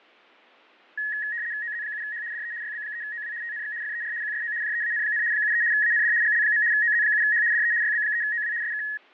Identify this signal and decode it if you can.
RTTY (75 baud, 170 Hz shift), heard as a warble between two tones, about 1800 Hz centre, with fading. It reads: OZ7H DE YB3OW TNX FER QSO JEAN, 73 AND GL. OZ7H DE YB3OW SK